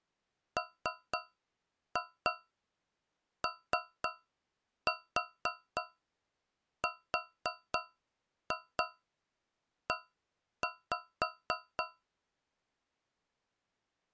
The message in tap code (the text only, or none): MORE